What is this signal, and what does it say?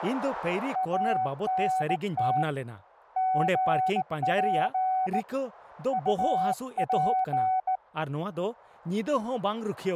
Morse code, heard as a keyed tone, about 17 wpm, 750 Hz, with radio static and speech in Santali. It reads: ANT GP UP